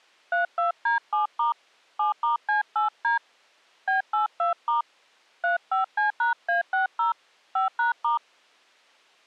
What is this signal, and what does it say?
DTMF, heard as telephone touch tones, dialled by hand, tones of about 130 ms. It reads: 32D7* 7*C8D B82* 35C#A60 5#*